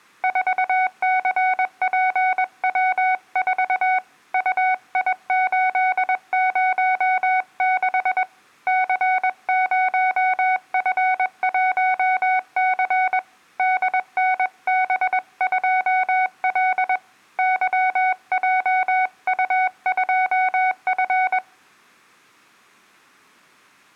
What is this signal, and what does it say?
Morse code, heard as a keyed tone, hand-sent with a paddle, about 21 wpm, 750 Hz, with room echo. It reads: 4CPW4 UI806 C0F1C DNB2L YJU2F